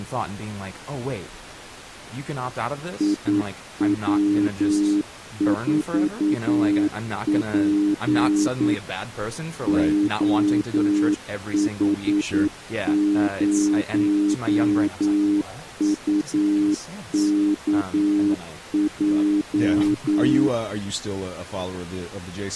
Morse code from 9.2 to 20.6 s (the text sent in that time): OH0UKJ